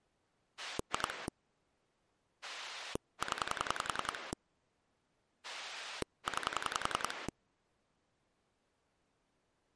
Pulse dialling, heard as a rotary dial, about 10 pulses a second. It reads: 2 0 9